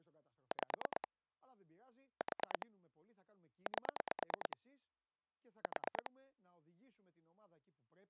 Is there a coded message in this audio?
Yes: pulse dialling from 0.5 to 6.1 s, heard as clicks on a phone line, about 9 pulses a second, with speech in Greek. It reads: 5 4 8 4